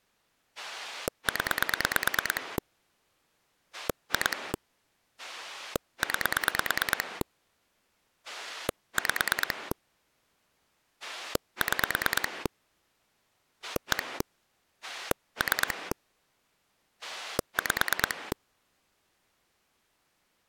Pulse dialling, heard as a rotary dial, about 9 pulses a second. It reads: 0 2 9 5 6 1 3 5